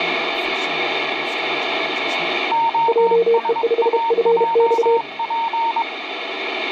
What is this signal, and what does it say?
Morse code, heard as two keyed tones, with radio static and speech in English. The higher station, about 22 wpm, 920 Hz: OSAJP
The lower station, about 32 wpm, 460 Hz: JE5FX